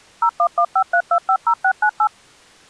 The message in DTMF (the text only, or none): 01153250698